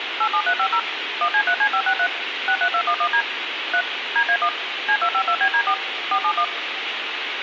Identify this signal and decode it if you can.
DTMF, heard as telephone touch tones, dialled by machine, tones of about 70 ms, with phone line noise. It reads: 87350 1C3C563 63211D 3 DA1 C252BD4 471